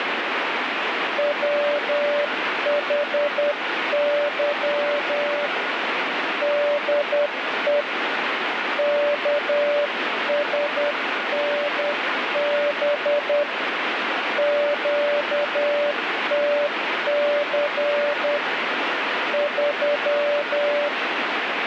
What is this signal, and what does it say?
Morse code, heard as a keyed tone, hand-sent with a paddle, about 10 wpm, 580 Hz, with radio static. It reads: WHY DE KSNB QTC 3